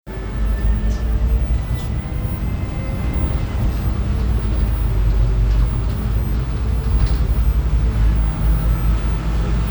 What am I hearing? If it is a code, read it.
The noise inside a bus. There is no code.